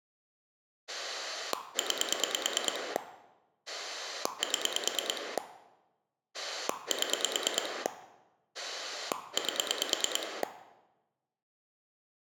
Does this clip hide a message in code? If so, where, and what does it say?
Yes: pulse dialling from 0.9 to 10.4 s, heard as a rotary dial, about 9 pulses a second, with room echo. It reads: 9 7 7 8